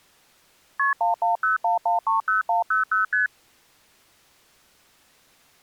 Multi-frequency trunk signalling (R1, as on North American trunks), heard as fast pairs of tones, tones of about 140 ms. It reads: KP 1101130100 ST